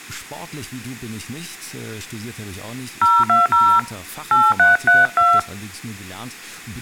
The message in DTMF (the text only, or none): 020 8332